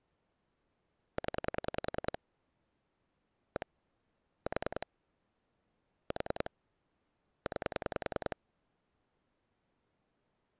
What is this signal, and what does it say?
Pulse dialling, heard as clicks on a phone line, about 10 pulses a second. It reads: 0 1 4 4 9